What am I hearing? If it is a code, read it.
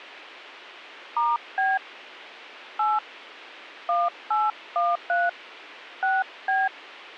DTMF, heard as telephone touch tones, dialled by hand, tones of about 200 ms, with a squelch burst at the end. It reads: *B 8 1813 6B